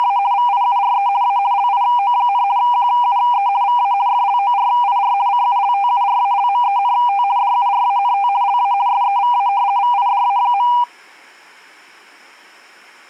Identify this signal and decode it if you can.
RTTY (50 baud, 170 Hz shift), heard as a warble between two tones, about 880 Hz centre. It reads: … VIURE A LIO, QUE VA FLORIR CULTURALMENT DURANT LA SEVA VIDA.